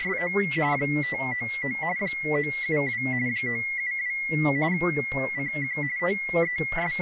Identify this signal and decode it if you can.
RTTY (45.45 baud, 170 Hz shift), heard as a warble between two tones, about 2050 Hz centre, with speech in English. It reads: … 599 972 972 CQ …